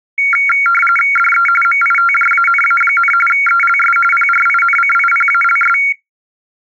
RTTY (45.45 baud, 850 Hz shift), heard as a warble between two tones, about 1800 Hz centre. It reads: DE MITJANA, ELS PRINCIPALS